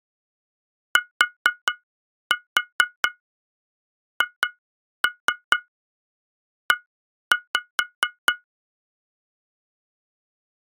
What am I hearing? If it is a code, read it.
Tap code, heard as taps on glass, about 4 knocks a second. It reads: THE